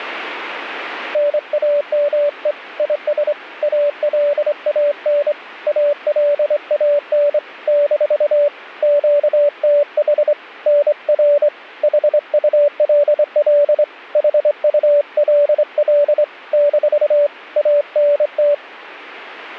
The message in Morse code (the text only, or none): NAME IS ALAN ALAN - QTH NR HULL HULL - ANT